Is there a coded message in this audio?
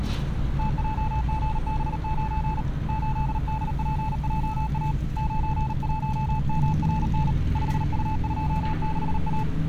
Yes: Morse code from 0.5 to 9.5 s, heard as a keyed tone, hand-sent with a paddle, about 38 wpm, 870 Hz, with street noise. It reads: TJGB9 8DPJA 91MRN 5U26A